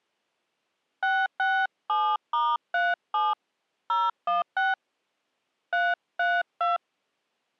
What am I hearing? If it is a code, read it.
DTMF, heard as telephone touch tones, dialled by hand, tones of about 200 ms. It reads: 667*37 016 332